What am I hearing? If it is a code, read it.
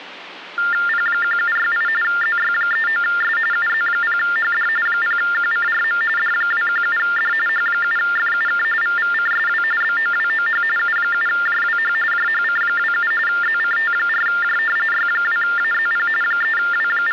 TTY/TDD text telephone tones (45.45 baud Baudot), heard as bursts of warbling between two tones, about 400 Hz shift, 1600 Hz centre, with phone line noise. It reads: P1768 ZY39S UZ0HD 0QCRM D217D H7FUK VVCSW BOWOH U7JWH JHC27 ZCT4J Y2AZP …